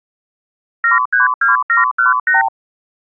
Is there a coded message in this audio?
Yes: multi-frequency trunk signalling (R2, with the far end's replies) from 0.8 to 2.5 s, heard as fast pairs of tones, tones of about 140 ms. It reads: 732718